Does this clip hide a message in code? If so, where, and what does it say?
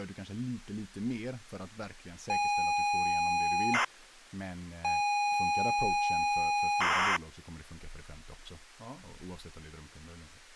Yes: ZX Spectrum tape loading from 2.3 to 7.2 s, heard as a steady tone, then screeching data, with speech in Swedish.